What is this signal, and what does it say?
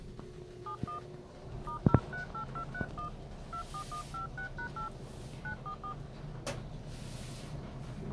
DTMF, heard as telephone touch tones, dialled by hand, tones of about 100 ms, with the noise inside a lift. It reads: 71 *038231 24156#8 944